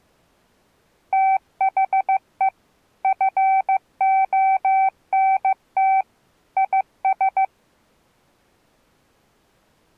Morse code, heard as a keyed tone, machine-sent, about 15 wpm, 770 Hz. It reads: THE FONT IS